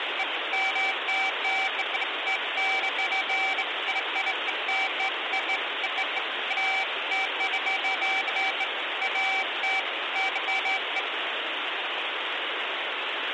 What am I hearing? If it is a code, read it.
Beeps of irregular length, with phone line noise. There is no code.